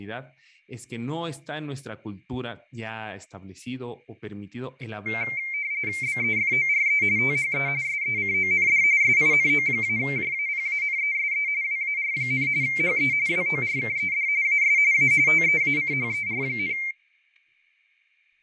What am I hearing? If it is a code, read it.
RTTY (45.45 baud, 170 Hz shift), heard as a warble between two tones, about 2200 Hz centre, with fading, static crashes and speech in Spanish. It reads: BEFORE THE SECOND SINO-JAPANESE WAR, HE WORKED AS A TEACHER,